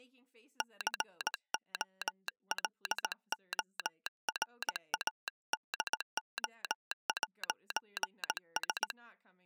Morse code, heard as a telegraph sounder, hand-sent with a paddle, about 18 wpm, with speech in English. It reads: COLORADO'S